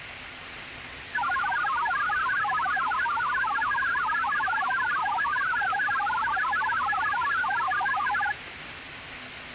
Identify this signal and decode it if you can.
Multi-tone FSK (Olivia or MFSK type), about 1000 Hz wide, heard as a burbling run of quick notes, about 62.5 baud, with radio static and kitchen noise.